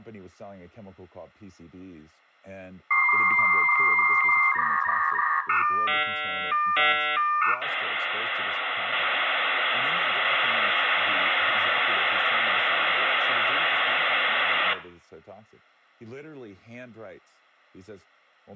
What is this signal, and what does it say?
Dial-up modem handshake (V.34 or later), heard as a whistle, warbles, then hiss, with room echo and speech in English.